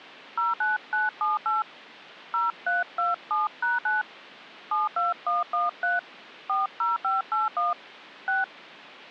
DTMF, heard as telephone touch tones, dialled by hand, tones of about 160 ms. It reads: 09978 0327#9 72113 40581 6